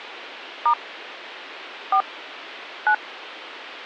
DTMF, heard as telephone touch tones, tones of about 80 ms. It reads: * 4 9